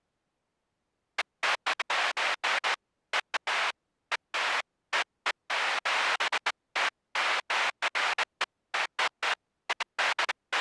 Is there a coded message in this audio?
No, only bursts of noise.